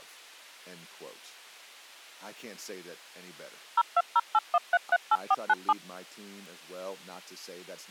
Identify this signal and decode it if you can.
DTMF, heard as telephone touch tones, dialled by machine, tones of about 40 ms, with speech in English. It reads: 02081338497